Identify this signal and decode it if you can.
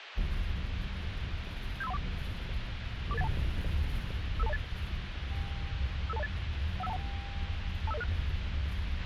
Five-tone selective call (EIA), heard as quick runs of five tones, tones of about 30 ms, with radio hiss, a squelch burst at the end and the noise inside a bus. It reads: 75314 44812 55208 55208 15121 25006